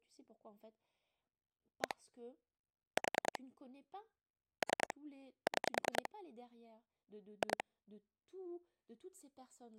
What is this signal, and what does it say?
Pulse dialling, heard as clicks on a phone line, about 10 pulses a second, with speech in French. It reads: 1 4 3 6 2